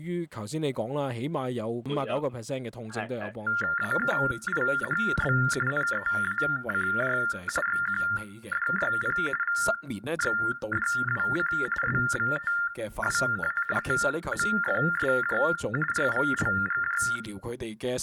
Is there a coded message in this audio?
Yes: TTY/TDD text telephone tones (45.45 baud Baudot) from 3.5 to 17.2 s, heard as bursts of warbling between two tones, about 400 Hz shift, 1600 Hz centre, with room echo. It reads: AKIHB NEACJ XQDYP VXDWC SVTWA TMFSJ RVLGJ